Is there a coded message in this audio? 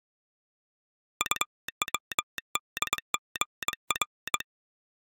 Yes: Morse code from 1.1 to 4.5 s, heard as a telegraph sounder, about 22 wpm. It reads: UWDGR